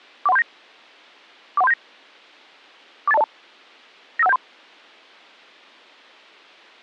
Five-tone selective call (EIA), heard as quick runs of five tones, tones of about 30 ms. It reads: 41379 41379 48202 95173